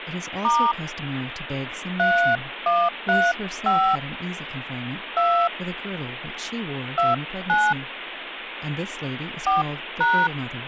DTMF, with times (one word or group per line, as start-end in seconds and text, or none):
0.4-0.7 *
2.0-4.0 3135
5.2-5.5 2
7.0-7.7 29
9.5-10.3 4#